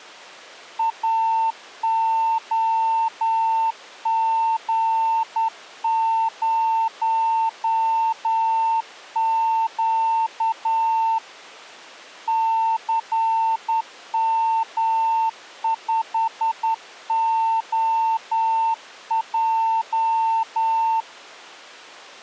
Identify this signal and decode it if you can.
Morse code, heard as a keyed tone, hand-sent with a straight key, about 10 wpm, 900 Hz. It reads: AOG0Q CM5OJ